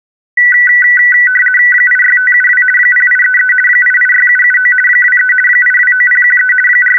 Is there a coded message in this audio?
Yes: RTTY (50 baud, 450 Hz shift) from 0.4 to 7.0 s, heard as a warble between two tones, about 1750 Hz centre. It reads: 86572 0833 886779 23 829013 …